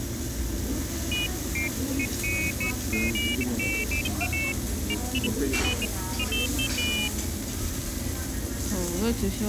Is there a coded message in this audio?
No, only pairs of high tones at irregular times, with the noise of a restaurant.